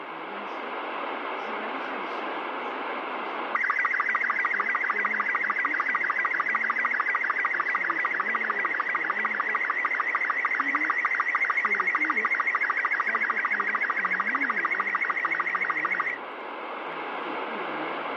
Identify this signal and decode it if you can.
SSTV (slow-scan television), Robot 36, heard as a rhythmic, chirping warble, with radio static.